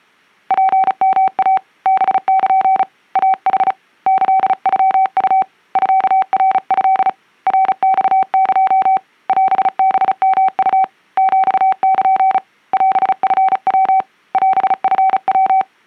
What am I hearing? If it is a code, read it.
Morse code (Japanese Wabun code), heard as a keyed tone, hand-sent with a paddle, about 35 wpm, 760 Hz. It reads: ツヨイ ハル イヌ キノウ ミナト ナマエ オハヨウ ヒル オチヤ オチヤ